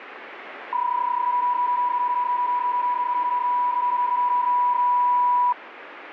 PSK31 (31.25 baud), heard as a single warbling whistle, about 980 Hz, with radio static.